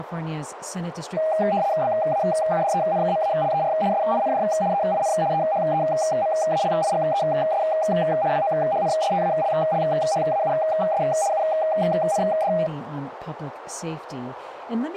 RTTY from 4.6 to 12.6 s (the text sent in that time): EIN EHEMALIGES WOHNSTALLHAUS UND